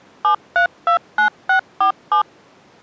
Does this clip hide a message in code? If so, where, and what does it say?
Yes: DTMF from 0.2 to 2.2 s, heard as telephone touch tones, dialled by machine, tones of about 100 ms. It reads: 7329647